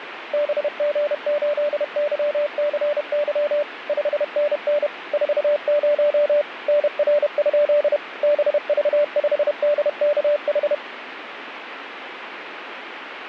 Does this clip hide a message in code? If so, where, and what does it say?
Yes: Morse code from 0.3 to 10.8 s, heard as a keyed tone, machine-sent, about 31 wpm, 590 Hz, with radio static. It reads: BG8YCY 5NN 40 NR? BV5DKH